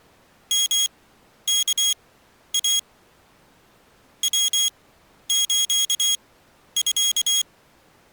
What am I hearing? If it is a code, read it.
Morse code (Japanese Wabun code), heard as a high beeper, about 24 wpm, spaced as for 11 wpm, 3300 Hz. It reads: ヨワイ ヤスミ